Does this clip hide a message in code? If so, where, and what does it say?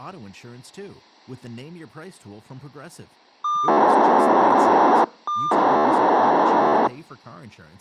Yes: POCSAG pager data (2400 baud) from 3.4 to 6.9 s, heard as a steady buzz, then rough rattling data, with speech in English.